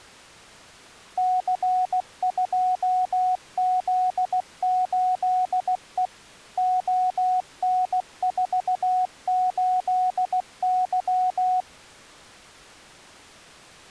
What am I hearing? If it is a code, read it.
Morse code, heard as a keyed tone, machine-sent, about 16 wpm, 740 Hz. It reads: C2Z8E ON48Y